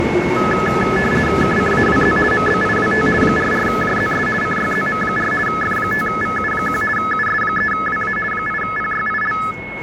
RTTY (50 baud, 450 Hz shift), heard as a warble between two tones, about 1500 Hz centre, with a steady whistle near 2180 Hz and the noise of a subway station. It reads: KCAWZ MBIWT 44JZS CYZM4 F5VU1 US3WA 8PYIL